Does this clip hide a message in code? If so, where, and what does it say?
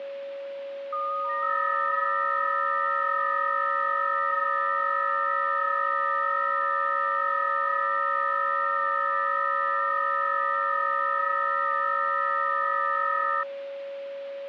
Yes: FT8 (several signals at once) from 0.9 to 13.4 s, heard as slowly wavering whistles, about 6.25 baud, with a steady whistle near 560 Hz.